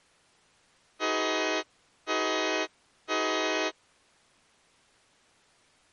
Train horn signal, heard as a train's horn. 3 short. On North American railways: when stopped, the train will back up.